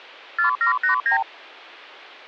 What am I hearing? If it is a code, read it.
Multi-frequency trunk signalling (R2, with the far end's replies), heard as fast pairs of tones, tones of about 110 ms. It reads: 4789